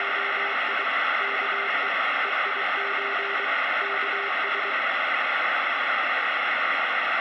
Morse code (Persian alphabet), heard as a keyed tone, machine-sent, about 23 wpm, 400 Hz, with heavy radio static. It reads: … که هیچ کس